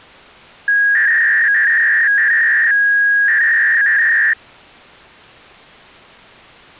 300-baud modem data (V.21 tones), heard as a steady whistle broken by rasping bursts, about 300 baud, 200 Hz shift.